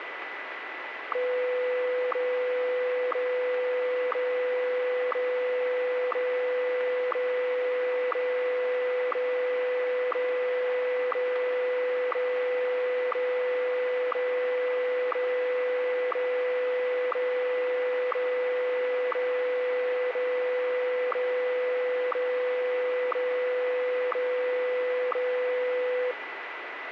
Radio time signal (WWVH, Hawaii), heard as ticks, one a second, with radio static and a steady whistle near 1990 Hz.